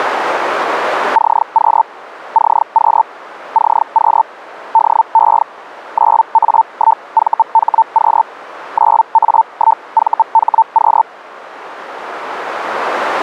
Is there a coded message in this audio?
Yes: Hellschreiber (Feld-Hell, 122.5 baud) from 1.1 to 11.0 s, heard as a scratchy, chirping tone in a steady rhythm, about 900 Hz. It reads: CQ CQ CQ DE 9A1VHQ 9A1VHQ